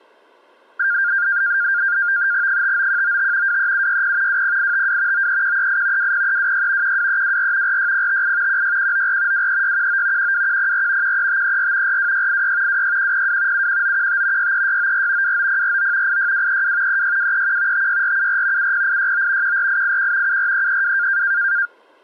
NAVTEX (SITOR-B), 100 baud, 170 Hz shift, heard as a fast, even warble, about 1500 Hz centre. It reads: 59195 23760 20852 93138 20326 12324 46058 16194 23619 12104 13534 42686 26102 71915 63694 29049 86232 36231 56474 70869 14881 74332